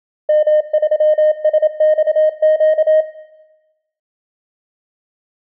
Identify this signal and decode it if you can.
Morse code, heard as a keyed tone, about 27 wpm, 620 Hz, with room echo. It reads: M3SXQ